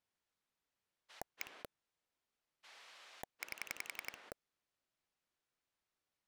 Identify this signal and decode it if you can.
Pulse dialling, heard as a rotary dial, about 11 pulses a second. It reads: 1 8